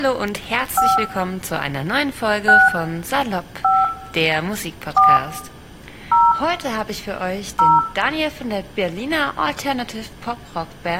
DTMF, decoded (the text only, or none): 5 6 5 4 0 0